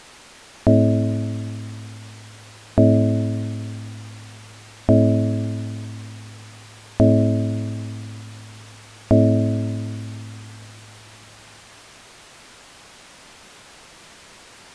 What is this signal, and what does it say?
Clock strike, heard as a bell. 5. Five o'clock.